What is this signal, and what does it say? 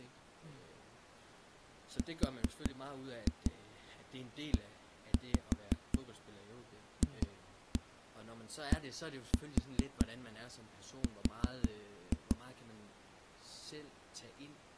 Tap code, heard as knocks on a wall, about 5 knocks a second, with speech in Danish. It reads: REFDR